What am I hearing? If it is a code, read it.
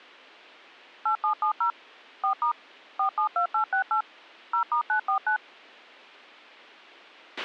DTMF, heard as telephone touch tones, dialled by machine, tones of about 100 ms, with a squelch burst at the end. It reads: 8770 4* 472868 0*949